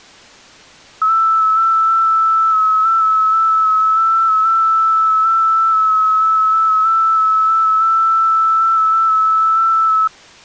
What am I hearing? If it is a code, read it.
FT8 (one signal), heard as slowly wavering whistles, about 6.25 baud.